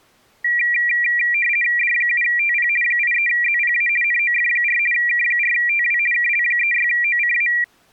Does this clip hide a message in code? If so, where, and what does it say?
Yes: RTTY (50 baud, 450 Hz shift) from 0.4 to 7.6 s, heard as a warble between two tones, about 2150 Hz centre. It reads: D7TP 83ZPA NOF4 K4TW KL36OCA